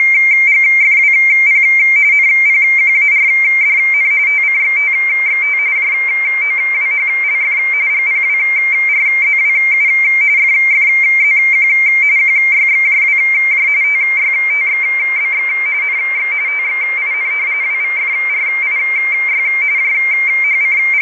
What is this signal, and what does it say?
RTTY (45.45 baud, 170 Hz shift), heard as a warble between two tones, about 2200 Hz centre, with radio static. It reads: … NPQARDN TCXTXT JOWHLF GPWRZWU FFZQ QYXJWJ TYTXBX NX TXIN WVFRIY …